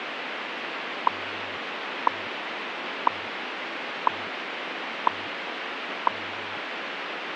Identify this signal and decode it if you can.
Radio time signal (WWV, Colorado), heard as ticks, one a second, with radio static.